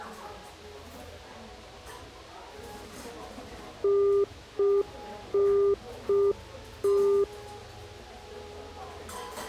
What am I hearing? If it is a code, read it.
Telephone call progress tone (UK plan), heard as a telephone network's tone, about 400 Hz, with the noise of a cafe. Congestion tone.